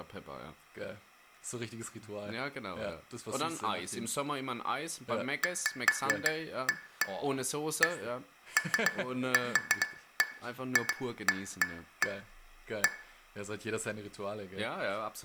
Irregular taps on glass, with room echo and speech in German. There is no code.